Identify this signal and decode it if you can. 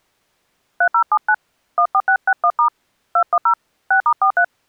DTMF, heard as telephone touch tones, dialled by hand, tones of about 70 ms. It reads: 3079 14661* 210 6*43